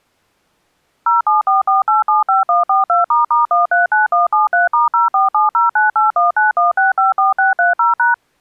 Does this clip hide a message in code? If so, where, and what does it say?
Yes: DTMF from 1.1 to 8.1 s, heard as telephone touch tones, dialled by machine, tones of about 150 ms. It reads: 0744875142**139173*047098191654630#